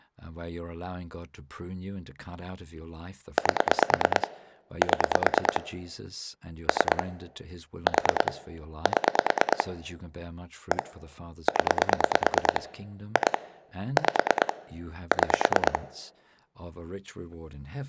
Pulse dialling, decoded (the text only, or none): 8 7 3 4 7 1 0 2 5 6